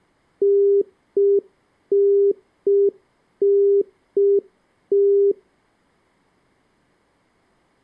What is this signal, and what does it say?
Telephone call progress tone (UK plan), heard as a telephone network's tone, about 400 Hz. Congestion tone.